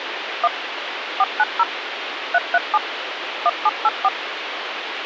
DTMF, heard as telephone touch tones, dialled by machine, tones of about 40 ms, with phone line noise. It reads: 1 490 337 1784